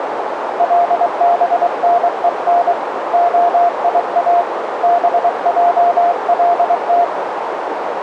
Morse code (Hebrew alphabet), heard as a keyed tone, hand-sent with a paddle, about 23 wpm, 700 Hz, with radio static and a narrow filter. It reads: לבנון היא בעלת